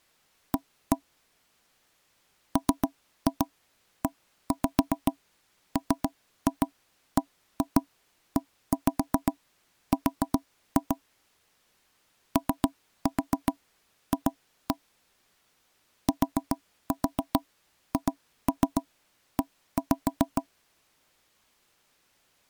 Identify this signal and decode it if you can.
Tap code, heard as knocks on wood, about 7 knocks a second. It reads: A MEMBER OF THE